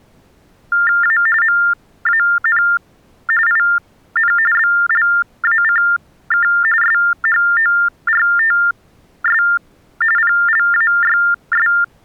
TTY/TDD text telephone tones (45.45 baud Baudot), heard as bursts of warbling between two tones, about 400 Hz shift, 1600 Hz centre. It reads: A MAN IN BLACK SHORTS PLAYS